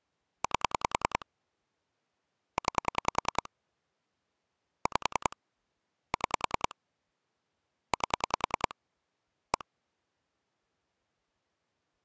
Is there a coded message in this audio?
Yes: pulse dialling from 0.4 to 9.6 s, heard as clicks on a phone line, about 10 pulses a second. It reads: 8 9 5 6 8 1